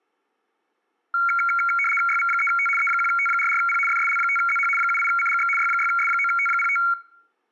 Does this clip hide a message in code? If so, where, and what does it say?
Yes: RTTY (75 baud, 850 Hz shift) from 1.1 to 6.9 s, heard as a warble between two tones, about 1800 Hz centre. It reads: YV3T E1T44P FSL5ZH 78CGX Y6S9T05